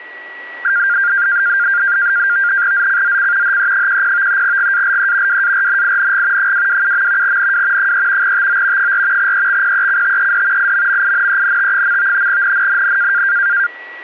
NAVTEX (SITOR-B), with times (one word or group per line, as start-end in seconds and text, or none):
2.7-3.6 ZCZC
3.4-4.4 HE10
4.4-5.4 GALE
5.3-6.5 WARNING
6.4-7.4 227.
7.2-7.9 NW
7.8-8.3 3
8.2-8.9 TO
8.8-9.3 4
9.2-10.7 EXPECTED
10.6-12.3 IMMINENT.
12.3-13.2 NNNN